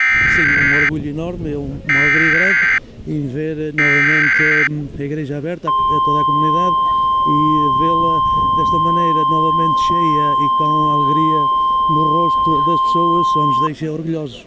Emergency Alert System (SAME) tones (header bursts, then the 1050 Hz attention tone), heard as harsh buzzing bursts, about 520.83 baud.